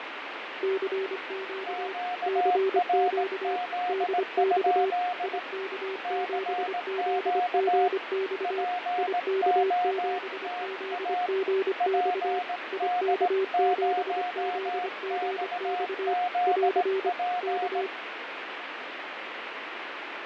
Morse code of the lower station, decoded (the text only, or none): CQ CQ DX IK7ZGX IK7ZGX IK7ZGX <AR> K